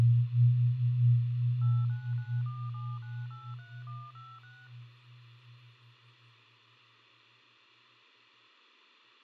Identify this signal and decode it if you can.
DTMF, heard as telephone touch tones, dialled by machine, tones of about 240 ms, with phone line noise. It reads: 89947983156